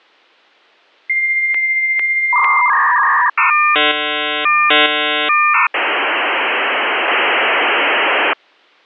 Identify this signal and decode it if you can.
Dial-up modem handshake (V.34 or later), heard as a whistle, warbles, then hiss.